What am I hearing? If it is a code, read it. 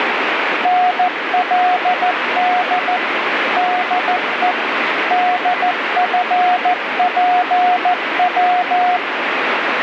Morse code, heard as a keyed tone, machine-sent, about 14 wpm, 720 Hz, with heavy radio static. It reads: NLD DE DFPW